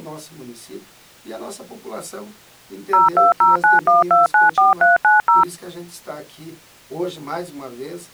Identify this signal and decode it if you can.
DTMF, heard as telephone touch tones, dialled by machine, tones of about 150 ms. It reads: 02091294390